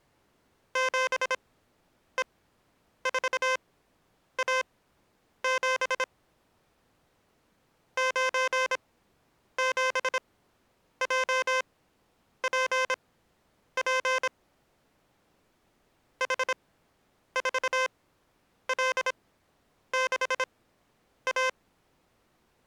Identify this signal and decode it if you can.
Morse code, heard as electronic beeps, machine-sent, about 26 wpm, spaced as for 9 wpm, 520 Hz. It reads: 7E4A7 97JPP H4L6A